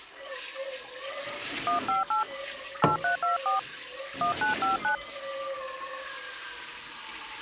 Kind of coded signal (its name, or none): DTMF